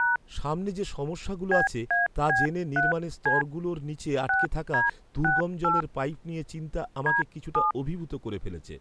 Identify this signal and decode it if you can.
DTMF, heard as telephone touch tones, dialled by hand, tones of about 160 ms, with speech in Bangla. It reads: # BAB3C 6D68 D7